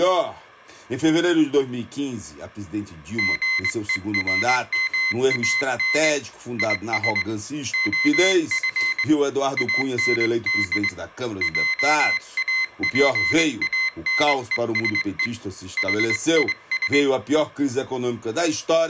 Morse code, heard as a high beeper, hand-sent with a straight key, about 21 wpm, 2050 Hz, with room echo. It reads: GERMAN IS OF AND JAPANESE HIS